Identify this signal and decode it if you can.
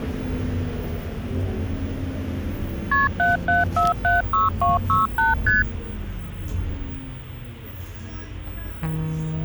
Multi-frequency trunk signalling (R1, as on North American trunks), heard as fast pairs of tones, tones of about 160 ms, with the noise inside a bus. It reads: KP 77476268 ST